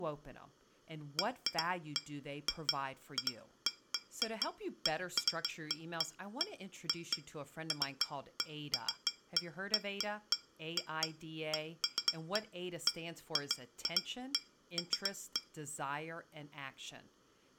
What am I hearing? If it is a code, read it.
Irregular taps on glass, with speech in English. There is no code.